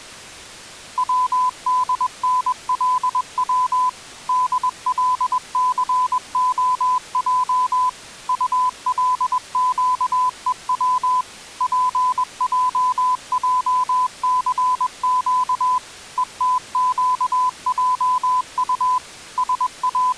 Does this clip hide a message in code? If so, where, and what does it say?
Yes: Morse code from 0.9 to 20.2 s, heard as a keyed tone, machine-sent, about 21 wpm, 1010 Hz. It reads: WDNLW DLCOJ ULQEW PJJCQ ETQJU …